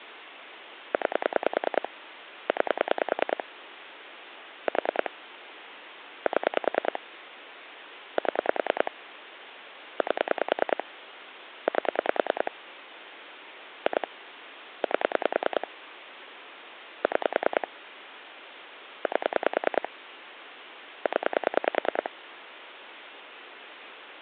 Pulse dialling, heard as clicks on a phone line, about 10 pulses a second, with phone line noise. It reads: 9 9 4 7 7 8 8 2 8 6 8 0